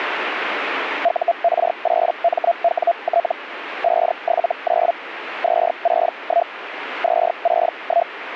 Hellschreiber (Feld-Hell, 122.5 baud), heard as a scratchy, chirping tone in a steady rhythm, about 680 Hz, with radio static. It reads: UR8MWT 579 261 261